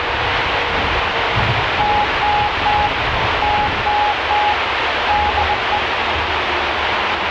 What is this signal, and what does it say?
Morse code, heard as a keyed tone, hand-sent with a bug key, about 20 wpm, 840 Hz, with heavy radio static and the noise inside a bus. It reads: TTT TTT DE